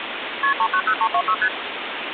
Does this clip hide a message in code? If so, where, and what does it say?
Yes: multi-frequency trunk signalling (R1, as on North American trunks) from 0.4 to 1.5 s, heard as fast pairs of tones, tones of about 70 ms, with phone line noise. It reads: KP 390326 ST